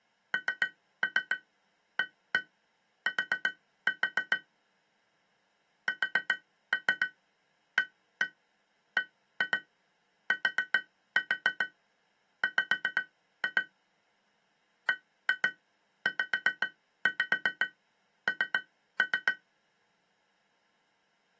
Tap code, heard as taps on glass, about 7 knocks a second. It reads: NAT SABTW BZN